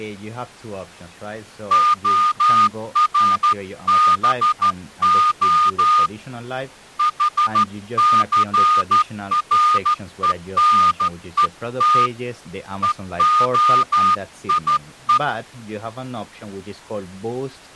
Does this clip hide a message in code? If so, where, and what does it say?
Yes: Morse code (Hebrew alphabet) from 1.7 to 15.2 s, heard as a whistle, hand-sent with a straight key, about 13 wpm, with speech in English. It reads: הרבה חסרונות והיו